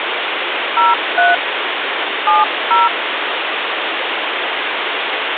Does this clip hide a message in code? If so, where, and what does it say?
Yes: DTMF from 0.8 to 2.9 s, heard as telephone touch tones, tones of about 170 ms, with phone line noise. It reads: 03 70